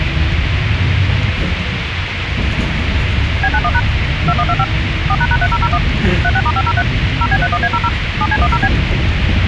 DTMF, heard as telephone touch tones, dialled by machine, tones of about 50 ms, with radio hiss and the noise inside a bus. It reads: B91# 2125 4##3001 36*503 0B31A00 7C10B